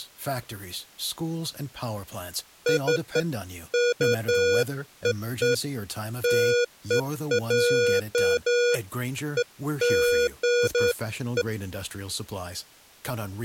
Beeps of irregular length, with speech in English. There is no code.